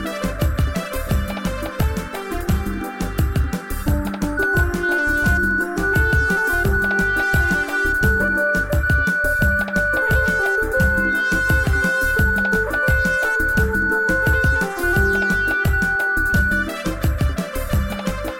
Radio time signal (DCF77), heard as a tone whose level steps once a second, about 1480 Hz, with radio static and a narrow filter. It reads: 1 1 0 0 1 0 0 0 0 0 1 0